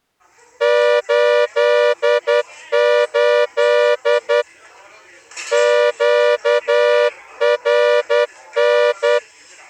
Morse code, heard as a horn, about 10 wpm, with the noise of a restaurant. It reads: 88 QRN